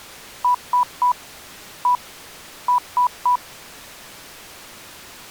Beep code, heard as beeps, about 990 Hz. 3-1-3. In Phoenix BIOS tables: interrupt mask register failure.